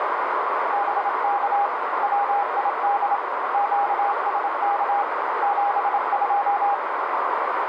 Morse code, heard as a keyed tone, hand-sent with a bug key, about 27 wpm, 810 Hz, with heavy radio static and a narrow filter. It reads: BK WID QSK 72